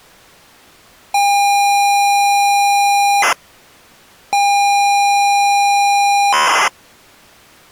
ZX Spectrum tape loading, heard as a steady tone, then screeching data.